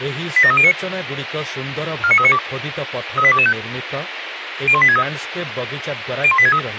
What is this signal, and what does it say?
Five-tone selective call (ZVEI), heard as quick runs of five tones, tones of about 70 ms, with radio hiss and speech in Odia. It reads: 87309 49392 38225 01863 01863